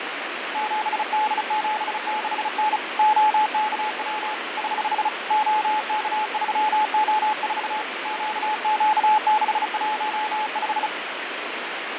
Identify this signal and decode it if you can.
Morse code, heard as a keyed tone, hand-sent with a bug key, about 35 wpm, 860 Hz, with radio static and fading. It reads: 7D76N OKW <HH> OK3O4 QQ615